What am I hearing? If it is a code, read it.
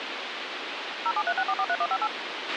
DTMF, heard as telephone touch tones, dialled by machine, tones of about 60 ms, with radio hiss and a squelch burst at the end. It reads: 0736443158